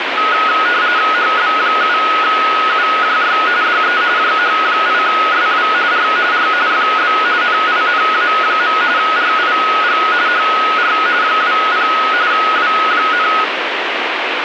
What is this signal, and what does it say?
RTTY (45.45 baud, 170 Hz shift), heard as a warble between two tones, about 1360 Hz centre, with radio static. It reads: HB7UJY DE JH8SW R R FB NINA. RIG HR 20 W,